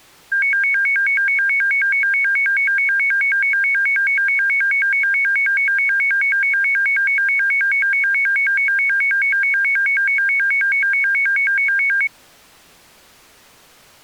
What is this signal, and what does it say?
A tone that alternates evenly between two pitches. There is no code.